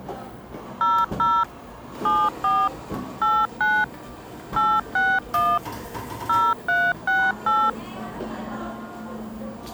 DTMF, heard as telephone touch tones, dialled by machine, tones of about 240 ms, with the noise of a cafe. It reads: 00 74 89 861 0368